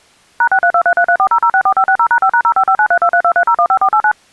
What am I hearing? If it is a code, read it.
DTMF, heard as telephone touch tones, dialled by machine, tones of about 70 ms. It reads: #63233340064560#5#055932323015489